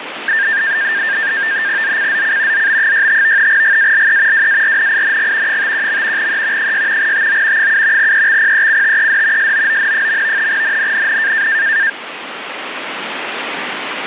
NAVTEX (SITOR-B), 100 baud, 170 Hz shift, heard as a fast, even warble, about 1700 Hz centre, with radio static. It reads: ZCZC ZB65 GALE WARNING 51. E 6 TO 7 EXPECTED SOON. NNNN